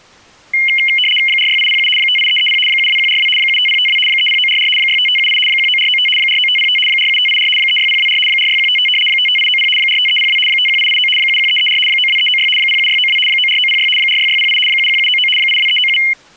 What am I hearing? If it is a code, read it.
RTTY (75 baud, 850 Hz shift), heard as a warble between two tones, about 2550 Hz centre. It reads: 46807 58330 72142 75052 30944 65578 19495 49505 47584 36024 46155 55890 45302 51889 71334 92396 07692 94906 46608 71799 82397